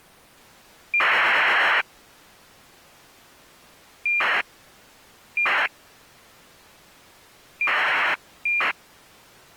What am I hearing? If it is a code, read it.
ACARS aircraft data, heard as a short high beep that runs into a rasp, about 2400 baud.